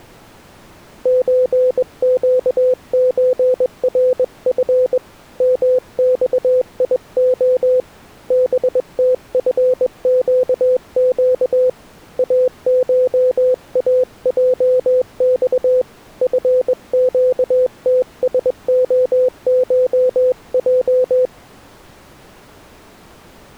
Morse code (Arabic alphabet), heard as a keyed tone, hand-sent with a straight key, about 21 wpm, 510 Hz. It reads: زقزرف مصيخ بتفقق اشاجص فقتسخشج